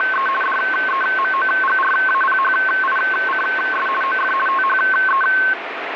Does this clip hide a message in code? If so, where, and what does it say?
Yes: RTTY (50 baud, 450 Hz shift) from 0.0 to 5.5 s, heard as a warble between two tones, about 1300 Hz centre, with radio static. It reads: … DEMOGRAPHICS OF THE